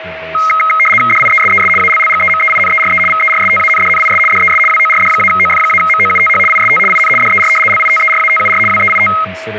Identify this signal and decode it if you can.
RTTY (75 baud, 850 Hz shift), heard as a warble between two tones, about 1700 Hz centre, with radio static, a steady whistle near 640 Hz and speech in English. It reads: DIESES ALLGEMEINERE VERSTANDNIS DES WORD-OF-MOUTH IST IN DER LITERATUR WEIT